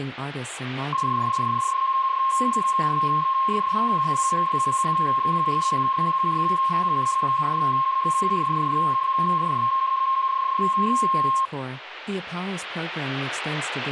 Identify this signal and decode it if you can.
PSK31 (31.25 baud), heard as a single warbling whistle, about 1070 Hz, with speech in English.